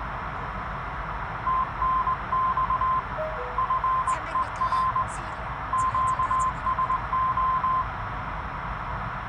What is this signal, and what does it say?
Morse code, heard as a keyed tone, hand-sent with a straight key, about 20 wpm, 1040 Hz, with radio static, a narrow filter and the noise inside a car. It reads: TNX FER QSO